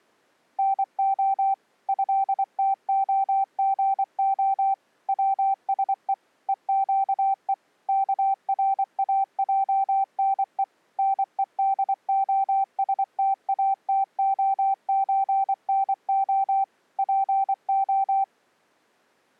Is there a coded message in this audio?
Yes: Morse code (Russian alphabet) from 0.5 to 18.3 s, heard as a keyed tone, machine-sent, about 24 wpm, 780 Hz. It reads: НО ЭТОГО ВСЕ ЕЩЕ КРАЙНЕ НЕДОСТАТОЧНО ПО